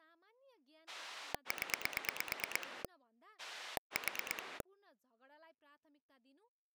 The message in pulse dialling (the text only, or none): 0 4